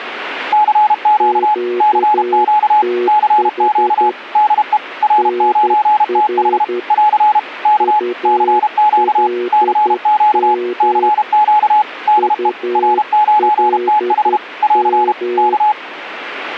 Morse code, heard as two keyed tones. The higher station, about 32 wpm, 850 Hz: CQ CQ CQ DE R9TH <AR> K CQ CQ CQ DE R9TH <AR> K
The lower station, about 11 wpm, 360 Hz: QTH NR ULM ULM